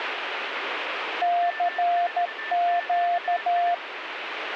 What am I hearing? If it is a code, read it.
Morse code, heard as a keyed tone, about 13 wpm, 700 Hz, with radio static and a weaker station near 1770 Hz. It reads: CQ